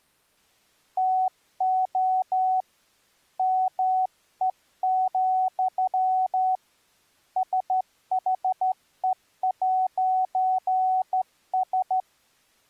Morse code, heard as a keyed tone, hand-sent with a straight key, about 13 wpm, 750 Hz. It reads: TO ME, SHE'S